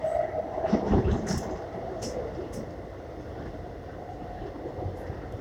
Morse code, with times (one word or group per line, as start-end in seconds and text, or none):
none